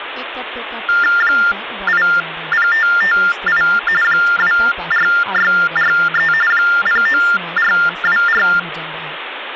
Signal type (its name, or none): TTY/TDD text telephone tones